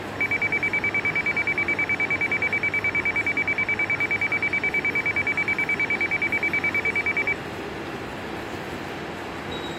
A tone that alternates evenly between two pitches, with room echo and the noise of a subway station. There is no code.